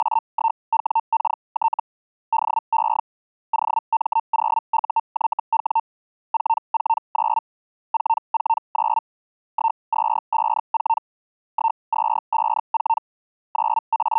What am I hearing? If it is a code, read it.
Hellschreiber (Feld-Hell, 122.5 baud), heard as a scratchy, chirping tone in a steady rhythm, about 900 Hz. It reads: … DE OM0UYW 449 449 1254 1254 …